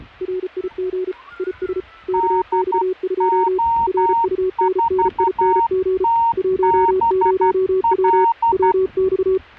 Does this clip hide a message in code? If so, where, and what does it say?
Yes: Morse code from 0.2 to 9.4 s, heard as two keyed tones, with the noise of a residential street. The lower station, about 34 wpm, 370 Hz: RIG IS KX2 RUNNING 10W WX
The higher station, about 12 wpm, 920 Hz: DO4TBL